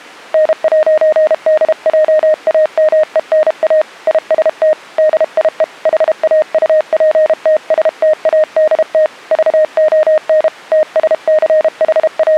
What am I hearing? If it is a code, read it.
Morse code, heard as a keyed tone, hand-sent with a paddle, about 32 wpm, 620 Hz. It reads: N'DJAMENA IST DIE HAUPTSTADT VON …